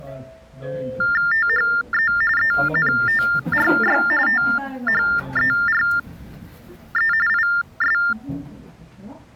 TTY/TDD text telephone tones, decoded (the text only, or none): THE ENTRY THERE IS